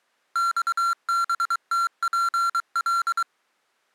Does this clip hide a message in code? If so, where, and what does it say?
Yes: Morse code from 0.3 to 3.3 s, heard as electronic beeps, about 23 wpm, 1370 Hz. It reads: XBTPL